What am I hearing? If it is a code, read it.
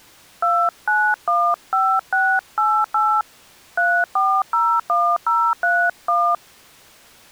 DTMF, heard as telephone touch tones, dialled by hand, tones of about 270 ms. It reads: 2915688 3401031